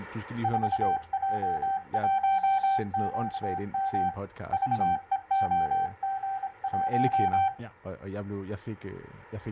Morse code, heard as a keyed tone, hand-sent with a paddle, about 26 wpm, 780 Hz, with speech in Danish. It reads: 4J1QM VEOG1